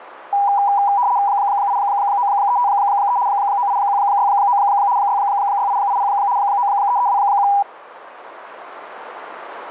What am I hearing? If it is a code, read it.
RTTY (75 baud, 170 Hz shift), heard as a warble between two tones, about 890 Hz centre, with radio static. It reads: 89353 98169 66880 93321